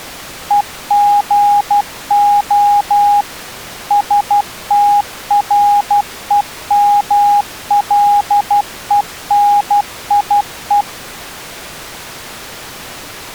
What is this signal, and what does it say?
Morse code (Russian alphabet), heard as a keyed tone, machine-sent, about 12 wpm, 820 Hz. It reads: ЕГО СТРЕМЛЕНИЕ